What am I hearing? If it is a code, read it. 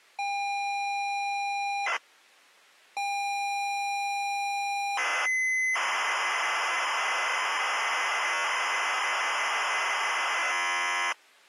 ZX Spectrum tape loading, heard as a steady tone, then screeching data.